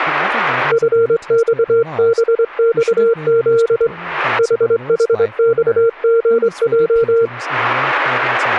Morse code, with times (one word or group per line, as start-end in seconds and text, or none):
0.7-3.9 FXBXZ
4.4-7.3 HHXGJ